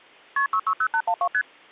Multi-frequency trunk signalling (R1, as on North American trunks), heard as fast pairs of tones, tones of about 70 ms. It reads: KP 660812 ST